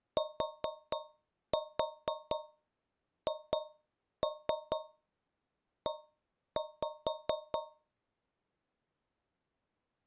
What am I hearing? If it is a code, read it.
Tap code, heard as taps on a metal pipe, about 4 knocks a second. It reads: THE